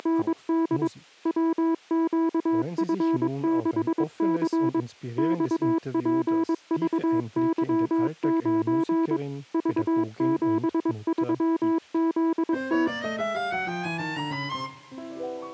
Morse code, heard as a keyed tone, machine-sent, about 22 wpm, 330 Hz. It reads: … WQF6C XPVY9 V73ZT